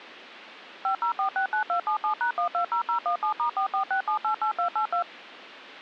DTMF, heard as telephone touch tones, dialled by machine, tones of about 100 ms. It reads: 50469277#120017*446788282